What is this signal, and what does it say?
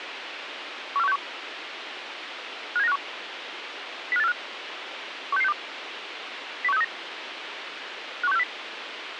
Five-tone selective call (EEA), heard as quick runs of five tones, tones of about 40 ms, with radio hiss. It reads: 14161 57951 05845 16662 01639 51640